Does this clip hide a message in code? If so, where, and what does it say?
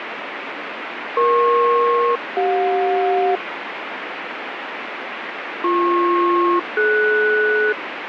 Yes: aircraft SELCAL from 1.2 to 7.7 s, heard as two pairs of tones, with radio static. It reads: EP-CJ BP-DS